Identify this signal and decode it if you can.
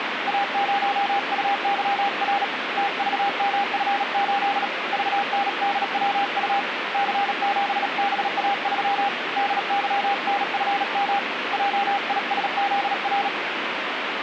Morse code, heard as a keyed tone, hand-sent with a paddle, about 37 wpm, 800 Hz, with radio static. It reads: A0UYR TVMF8 VNDWU C7BA3 DYNFM JISZR